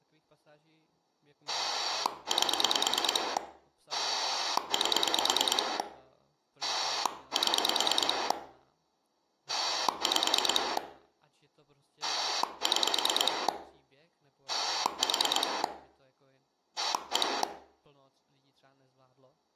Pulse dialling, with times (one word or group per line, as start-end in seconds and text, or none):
1.5-3.4 8
3.9-5.8 8
6.6-8.3 7
9.5-10.8 5
12.0-13.5 6
14.5-15.6 4
16.8-17.4 1